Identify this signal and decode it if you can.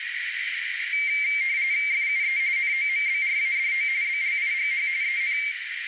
RTTY (45.45 baud, 170 Hz shift), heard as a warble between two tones, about 2200 Hz centre, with radio static and a narrow filter. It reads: FUE NOMBRADO BLIGH EN